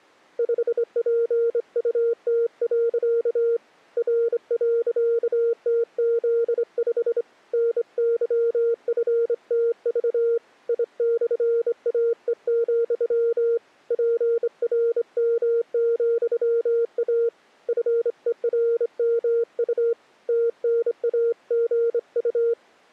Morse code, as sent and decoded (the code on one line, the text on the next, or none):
..... .--. ..- - .-.-.- / .-. .-.-.- - --.. ..... / -. -.-- ..-. - ...- / .. -..-. .- . --..-- / .--. .-. -- --..-- .- / ..-. . .-. -- ..- / - -. .- --. ..-
5PUT. R.TZ5 NYFTV I/AE, PRM,A FERMU TNAGU